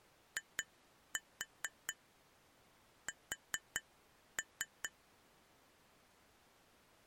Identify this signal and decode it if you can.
Tap code, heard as taps on glass, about 4 knocks a second. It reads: IS